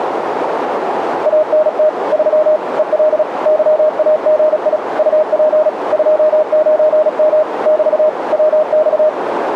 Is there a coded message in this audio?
Yes: Morse code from 1.2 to 9.2 s, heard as a keyed tone, machine-sent, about 36 wpm, 620 Hz, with radio static and a narrow filter. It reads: ANT 3 EL YAGI UP 29M <BT> WX